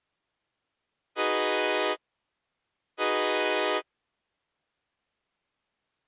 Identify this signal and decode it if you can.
Train horn signal, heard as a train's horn. 2 short. On North American railways: a signal is acknowledged.